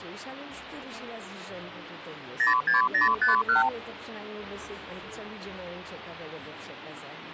Multi-frequency trunk signalling (R2, with the far end's replies), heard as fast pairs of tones, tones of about 140 ms. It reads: 06051